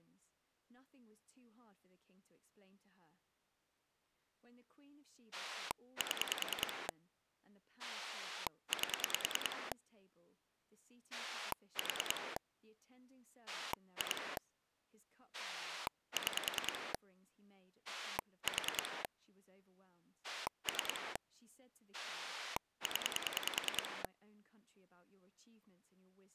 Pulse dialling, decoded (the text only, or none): 7 8 4 2 6 4 3 0